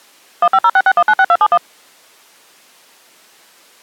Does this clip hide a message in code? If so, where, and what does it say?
Yes: DTMF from 0.4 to 1.6 s, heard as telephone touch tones, dialled by machine, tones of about 60 ms. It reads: 15066196271